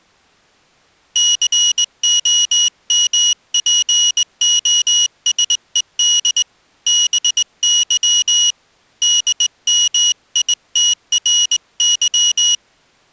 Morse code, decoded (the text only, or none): COMPOSED BY DMITRY